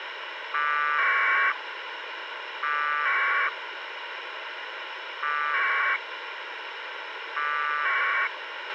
Packet radio (AX.25, as in APRS), 1200 baud, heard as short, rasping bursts, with radio hiss and a squelch burst at the end.